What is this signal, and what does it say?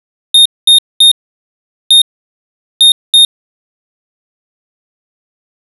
Beep code, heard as a piezo beeper, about 3700 Hz. 3-1-2. In Phoenix BIOS tables: DMA register failure.